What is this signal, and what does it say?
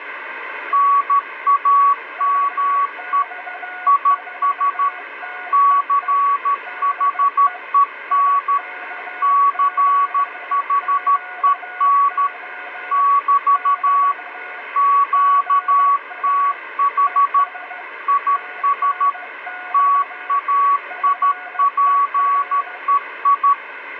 Morse code, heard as two keyed tones, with radio static. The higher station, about 13 wpm, 1130 Hz: NAME IS CHEN CHEN <BT> QTH IS TAIPEI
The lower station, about 15 wpm, 730 Hz: UX4TEE DE IK7QO <BT> GA ES TNX FER